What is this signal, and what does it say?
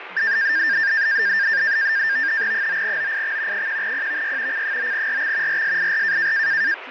NAVTEX (SITOR-B), 100 baud, 170 Hz shift, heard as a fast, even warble, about 1700 Hz centre, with radio static and speech in Hindi. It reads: 9OIX 1PVY C9RX RSIR